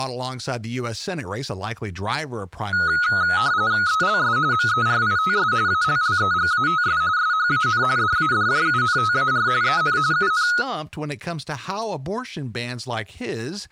RTTY (45.45 baud, 170 Hz shift), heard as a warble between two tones, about 1360 Hz centre, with speech in English. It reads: ELS MERITS ALLEGATS SHAN DADJUNTAR EN UN